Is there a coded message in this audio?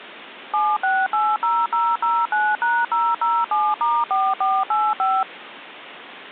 Yes: DTMF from 0.5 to 5.2 s, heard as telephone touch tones, dialled by machine, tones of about 230 ms, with phone line noise. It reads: 7680009#007*4485